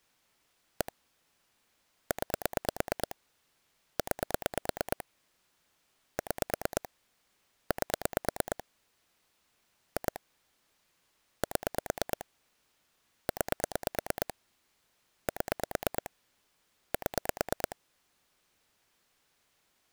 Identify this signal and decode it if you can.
Pulse dialling, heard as clicks on a phone line, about 9 pulses a second. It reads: 1 9 9 6 8 2 7 9 7 7